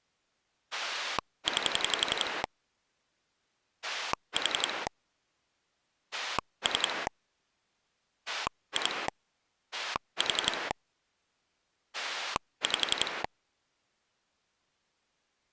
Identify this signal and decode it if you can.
Pulse dialling, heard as a rotary dial, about 11 pulses a second. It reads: 9 4 3 2 4 5